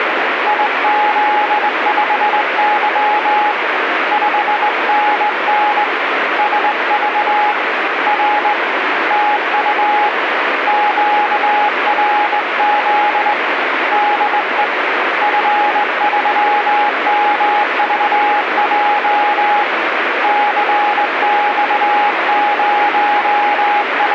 Morse code, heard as a keyed tone, hand-sent with a straight key, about 20 wpm, 830 Hz, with radio static. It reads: IZ5Y 5NN SV R TU QRZ DE F3MVJ …